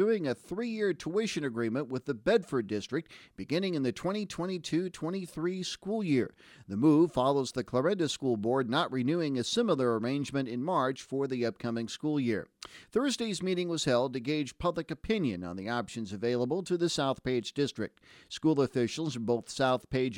Speech in English. There is no code.